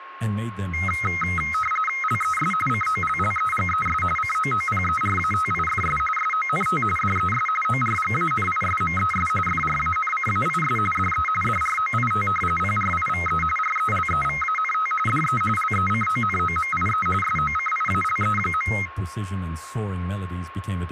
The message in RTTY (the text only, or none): LES COLLEGES COOPERATIFS SONT DES ORGANISMES FRANCAIS DE DROIT PRIVE RELEVANT DE LECONOMIE SOCIALE.